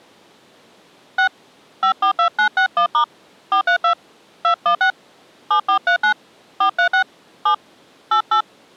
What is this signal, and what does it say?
DTMF, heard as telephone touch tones, dialled by hand, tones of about 100 ms. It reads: 6 542961* 432 216 7439 436 7 88